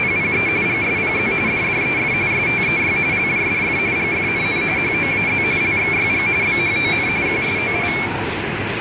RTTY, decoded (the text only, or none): … GSPZ DDEF STEY LJDF GFNN HOAZ LXYG BHON QSOI